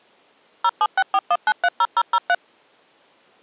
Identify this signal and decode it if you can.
DTMF, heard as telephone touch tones, dialled by machine, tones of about 50 ms. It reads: 07641930003